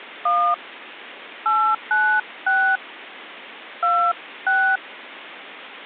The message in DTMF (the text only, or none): 1 896 26